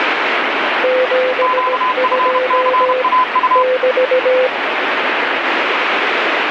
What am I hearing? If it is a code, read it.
Morse code, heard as two keyed tones, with heavy radio static. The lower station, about 17 wpm, 510 Hz: 72 <BT>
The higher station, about 31 wpm, 1020 Hz: QFCAU